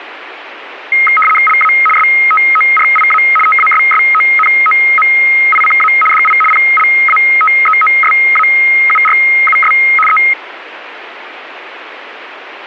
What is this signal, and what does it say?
RTTY (75 baud, 850 Hz shift), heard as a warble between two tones, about 1700 Hz centre, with radio static. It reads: LA STORIA TASSONOMICA DI PLATEOSAURUS E